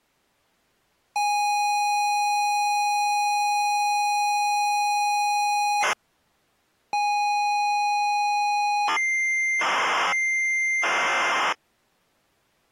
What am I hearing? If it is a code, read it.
ZX Spectrum tape loading, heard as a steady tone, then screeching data.